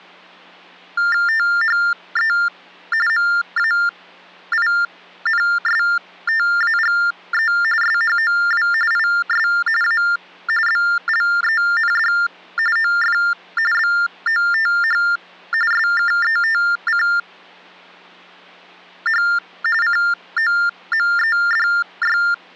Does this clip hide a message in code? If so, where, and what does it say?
Yes: TTY/TDD text telephone tones (45.45 baud Baudot) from 1.0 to 22.3 s, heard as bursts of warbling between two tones, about 400 Hz shift, 1600 Hz centre. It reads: THE MAINSTAGE SHOW IS A BLEND OF BOTH SKETCH COMEDY